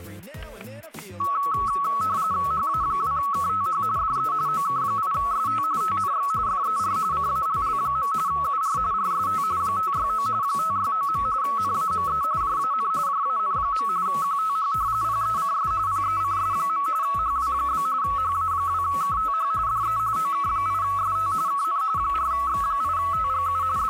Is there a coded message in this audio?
Yes: RTTY (45.45 baud, 170 Hz shift) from 1.2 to 23.9 s, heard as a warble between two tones, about 1210 Hz centre, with static crashes. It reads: HA2KTH DE OK8ST TNX FER CALL. UR RST 569 569. NAME JAN JAN. QTH PECS PECS. HW? HA2KTH DE OK8ST KN 4X8TGU …